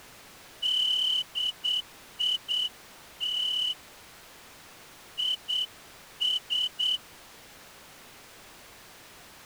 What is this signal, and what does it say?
Morse code, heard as a whistle, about 8 wpm. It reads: DIT IS